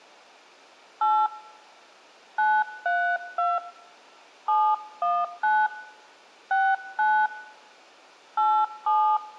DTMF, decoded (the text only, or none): 8 932 719 69 87